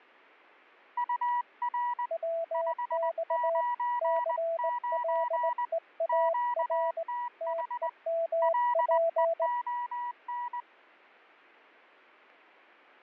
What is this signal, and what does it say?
Morse code, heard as two keyed tones, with static crashes. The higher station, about 20 wpm, 970 Hz: UR 599 QTH LEON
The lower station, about 19 wpm, 660 Hz: WX CLEAR TEMP